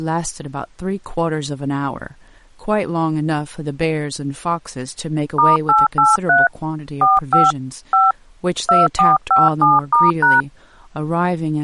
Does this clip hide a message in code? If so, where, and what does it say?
Yes: DTMF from 5.4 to 10.4 s, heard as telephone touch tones, dialled by hand, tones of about 180 ms, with speech in English. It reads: *883 45 5 2457*#